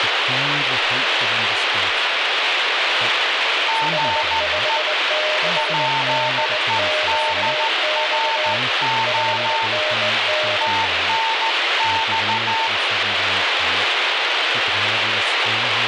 Morse code, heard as two keyed tones, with radio static and speech in English. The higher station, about 14 wpm, 900 Hz: GE PEDRO TNX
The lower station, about 21 wpm, 610 Hz: S56DQX 5NN